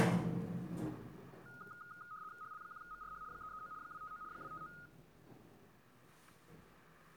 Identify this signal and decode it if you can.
RTTY (75 baud, 170 Hz shift), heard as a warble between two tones, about 1340 Hz centre, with static crashes. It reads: HL1MRH 339 259 259